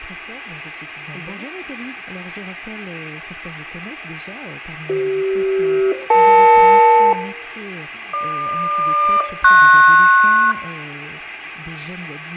Aircraft SELCAL, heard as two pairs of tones, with radio static, fading and room echo. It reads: CF-EL GQ-PS